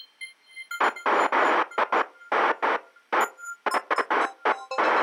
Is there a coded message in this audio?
No, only bursts of noise.